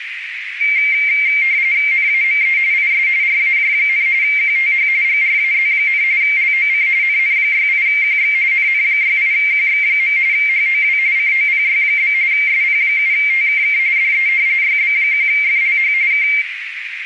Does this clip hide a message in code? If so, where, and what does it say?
Yes: RTTY (45.45 baud, 170 Hz shift) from 0.6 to 16.4 s, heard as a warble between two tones, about 2200 Hz centre, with radio static and a narrow filter. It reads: NAME IS RAJ, QTH GRAZ, LOC NN68QX NN68QX. HOW COPY? SP7TKK DE YB1FLH K